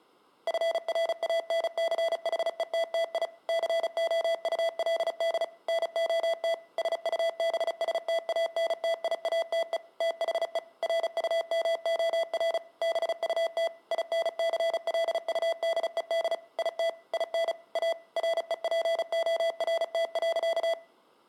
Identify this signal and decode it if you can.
Morse code, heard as electronic beeps, machine-sent, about 35 wpm, 660 Hz. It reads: FRANCHETTI COULD NOT SUBSTANTIATE THE RUMOR BUT INCLUDED IT IN A REPORT.